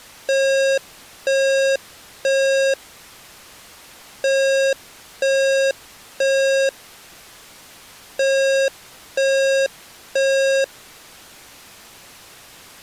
Alarm pattern, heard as an alarm's beeps, played three times, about 540 Hz. Temporal three. Smoke or fire, evacuate.